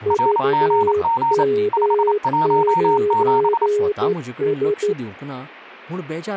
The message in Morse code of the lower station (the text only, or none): VM9S